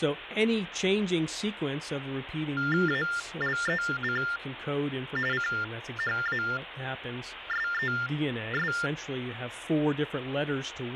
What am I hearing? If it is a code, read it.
TTY/TDD text telephone tones (45.45 baud Baudot), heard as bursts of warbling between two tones, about 400 Hz shift, 1600 Hz centre, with phone line noise. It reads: ALEC CHASES